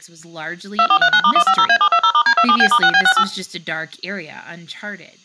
DTMF, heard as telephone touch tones, dialled by machine, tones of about 70 ms, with speech in English. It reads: 2439*150A720*D27B*6B68